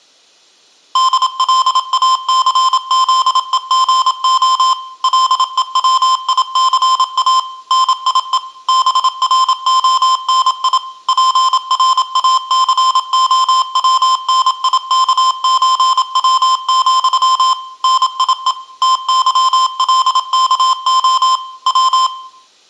Morse code (with Polish letters), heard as electronic beeps, machine-sent, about 27 wpm, 1040 Hz, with room echo. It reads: DLACZEGO LEWICA NIE BRONI PRACOWNIKÓW, NIE TYLKO W